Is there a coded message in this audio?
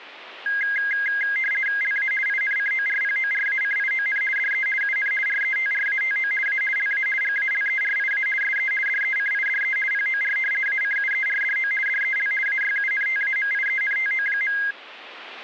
Yes: RTTY (50 baud, 450 Hz shift) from 0.5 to 14.7 s, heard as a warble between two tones, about 1850 Hz centre. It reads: LA INCORPORACION DE UN RETRATO A LA GALERIA SE DECIDE POR ACUERDO DEL AYUNTAMIENTO.